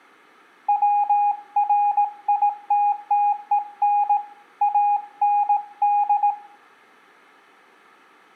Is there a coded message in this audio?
Yes: Morse code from 0.6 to 6.4 s, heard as a keyed tone, hand-sent with a paddle, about 18 wpm, 820 Hz, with room echo. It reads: WRITTEN AND